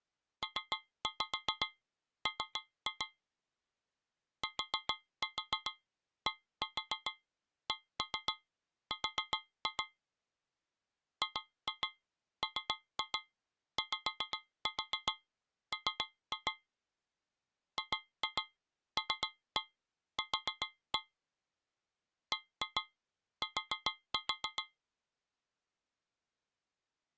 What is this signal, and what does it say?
Tap code, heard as taps on a metal pipe, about 7 knocks a second. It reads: PM TDCR GMYM GLQ BT